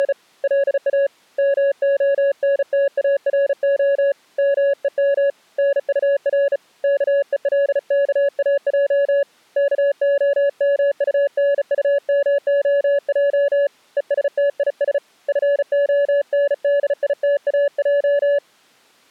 Morse code, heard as a keyed tone, hand-sent with a bug key, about 35 wpm, 560 Hz. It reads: … LA MONTARO MEM NUR KELKAJ KOMUNUMOJ ESTIS FONDITAJ